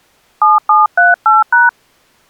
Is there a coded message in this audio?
Yes: DTMF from 0.4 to 1.7 s, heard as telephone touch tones, dialled by hand, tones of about 170 ms. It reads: 7738#